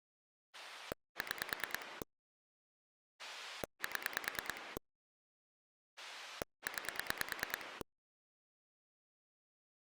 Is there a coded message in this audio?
Yes: pulse dialling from 0.5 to 7.8 s, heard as a rotary dial, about 9 pulses a second. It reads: 6 7 9